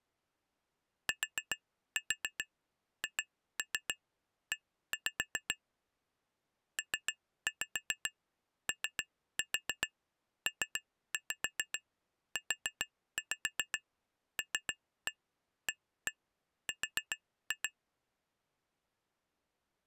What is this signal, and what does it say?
Tap code, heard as taps on glass, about 7 knocks a second. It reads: THE POPULAR